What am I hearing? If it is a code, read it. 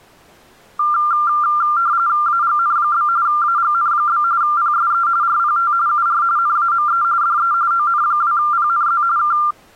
RTTY (45.45 baud, 170 Hz shift), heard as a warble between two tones, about 1280 Hz centre. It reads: AGN? AGN? PSE RPT UR NAME DE ON2PNZ K